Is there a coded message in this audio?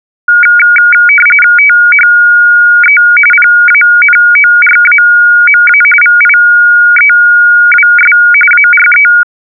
Yes: RTTY (45.45 baud, 850 Hz shift) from 0.3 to 9.2 s, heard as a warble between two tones, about 1850 Hz centre. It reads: THE PANORAMA VIEWS ARE